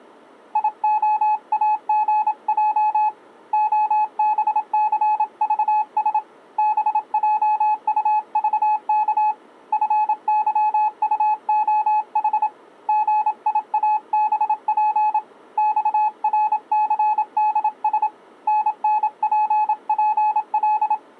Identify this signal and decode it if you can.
Morse code, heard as a keyed tone, hand-sent with a paddle, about 27 wpm, 850 Hz. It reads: IOAGJ OBCVS BJUVK FYUOH GIABP XRCDS NNPPL